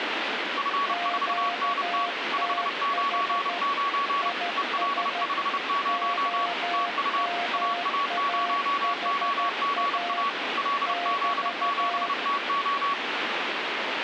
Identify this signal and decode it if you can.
Morse code, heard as two keyed tones, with radio static. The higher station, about 30 wpm, 1130 Hz: F4NT 599 EL50 TU AA0OGA LZ7TO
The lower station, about 13 wpm, 700 Hz: QTH IS OMAHA <BT>